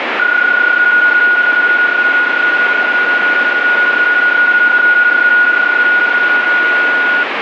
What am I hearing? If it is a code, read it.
PSK31 (31.25 baud), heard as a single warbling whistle, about 1450 Hz, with radio static.